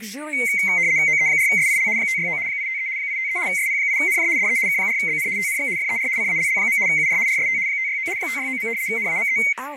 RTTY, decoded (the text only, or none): OE4SIL 569 853 853 SP8NJ DE K4BN TNX FER CALL. UR RST 569 569. NAME